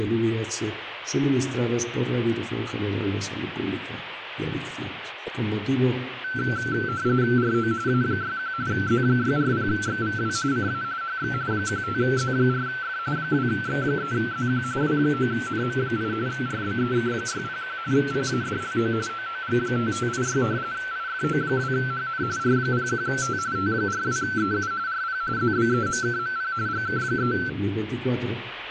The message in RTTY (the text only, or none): RO A61 Z640XVW CA HX 15Z4F 2X3ZQ W9NM8 RBEK601 PADLO OOG5586 IFO2HN R01T T42EU RP ZBEMKMP GK3